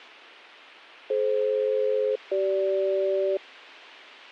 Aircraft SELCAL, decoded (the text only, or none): DF-CG